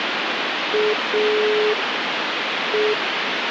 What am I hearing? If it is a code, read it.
Telephone call progress tone (pulsed, as in Italy), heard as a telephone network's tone, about 420 Hz, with phone line noise. Dial tone.